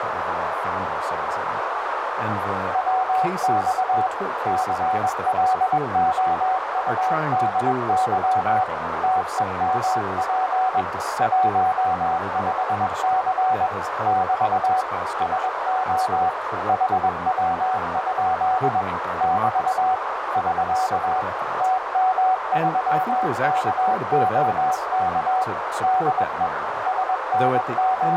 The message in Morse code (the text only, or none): WX CLOUDY TEMP 15C <BT> SO HW? <BT> <SK> TM3KOK DE …